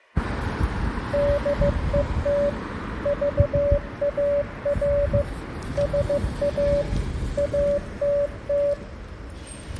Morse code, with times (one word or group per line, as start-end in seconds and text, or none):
1.1-2.5 DET
3.1-5.2 VAR
5.8-6.8 SA
7.4-8.7 ATT